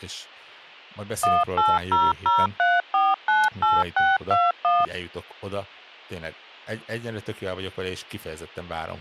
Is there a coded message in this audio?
Yes: DTMF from 1.2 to 4.8 s, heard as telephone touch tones, dialled by machine, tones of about 200 ms, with speech in Hungarian. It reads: 18003498621